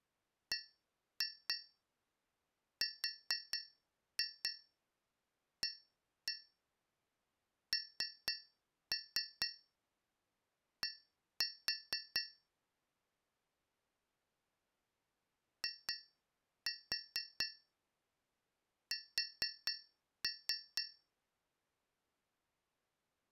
Tap code, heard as taps on a metal pipe, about 4 knocks a second. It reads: BRAND IS